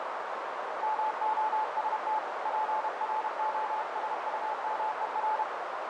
Morse code, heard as a keyed tone, hand-sent with a paddle, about 31 wpm, 870 Hz, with heavy radio static and a narrow filter. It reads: MOST PROSUMER